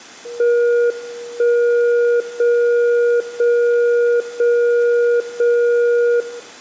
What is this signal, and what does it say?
Radio time signal (JJY), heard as a tone whose level steps once a second, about 480 Hz, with room echo. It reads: 1 0 0 0 0 0